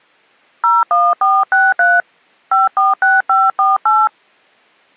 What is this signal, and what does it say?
DTMF, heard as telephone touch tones, dialled by hand, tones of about 190 ms. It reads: 01463 546548